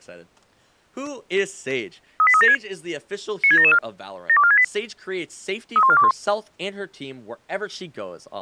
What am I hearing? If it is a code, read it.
Five-tone selective call (ZVEI), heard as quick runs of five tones, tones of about 70 ms, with speech in English. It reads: 38376 96774 72468 31421